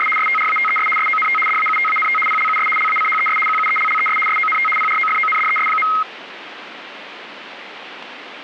RTTY (75 baud, 850 Hz shift), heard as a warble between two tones, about 1700 Hz centre, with radio static. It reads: … STRATES SONT DAUTANT PLUS LACHES QUELLES SONT PROFONDES.